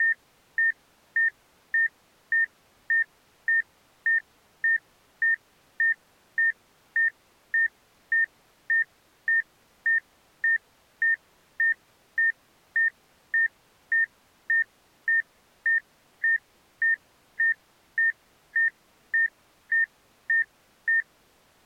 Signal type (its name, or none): none